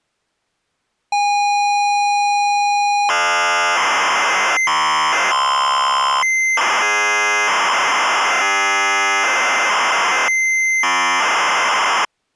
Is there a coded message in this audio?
Yes: ZX Spectrum tape loading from 1.1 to 12.1 s, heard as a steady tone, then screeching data.